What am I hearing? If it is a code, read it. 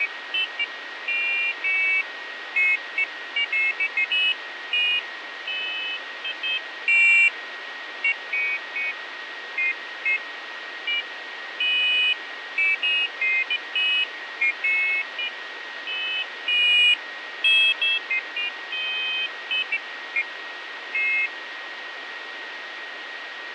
Pairs of high tones at irregular times, with radio static, fading and a steady whistle near 1880 Hz. There is no code.